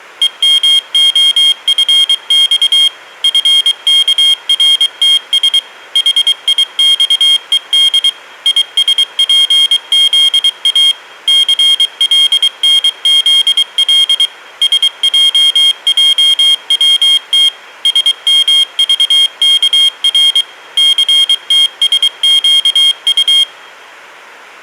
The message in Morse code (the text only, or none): EMOFX FKRTS HIXED ISPZA CLNZL SJJWT SMVKR CTSQU